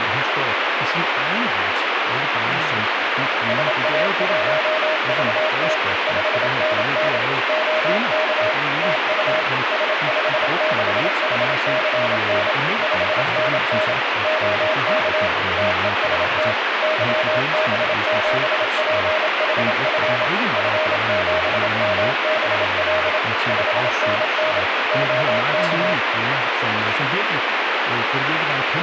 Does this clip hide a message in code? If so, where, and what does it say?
Yes: Morse code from 3.4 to 26.0 s, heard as a keyed tone, machine-sent, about 27 wpm, 630 Hz, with heavy radio static and speech in Danish. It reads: SA1VT 5NN OK TU S56HCN 5NN OK TEST YB7PHF F7MBL 5NN OK